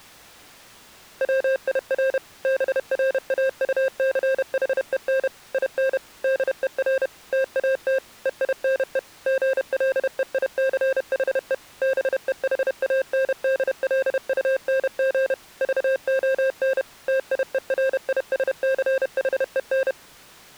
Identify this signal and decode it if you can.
Morse code, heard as electronic beeps, machine-sent, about 31 wpm, 530 Hz. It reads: WIR BRAUCHEN IN DER TAT EINE GLEICHE BEHANDLUNG VON TIERISCHEN